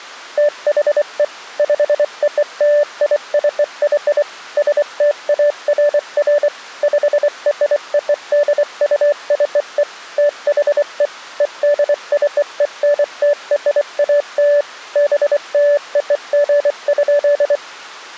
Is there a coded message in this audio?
Yes: Morse code (American railroad code) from 0.3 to 17.6 s, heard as a keyed tone, machine-sent, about 580 Hz. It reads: THE POLICY STAFF PRODUCE THE EDCENTRAL BLOG.